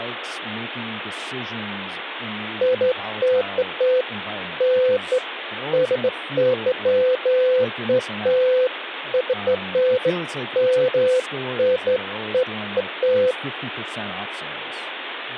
Beeps of irregular length, with phone line noise and speech in English. There is no code.